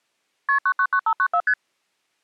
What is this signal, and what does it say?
Multi-frequency trunk signalling (R1, as on North American trunks), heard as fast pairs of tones, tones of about 70 ms. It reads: KP 999594 ST